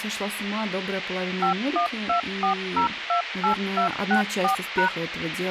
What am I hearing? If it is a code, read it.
DTMF, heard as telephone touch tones, dialled by machine, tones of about 110 ms, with radio hiss and speech in Russian. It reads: 5124028264#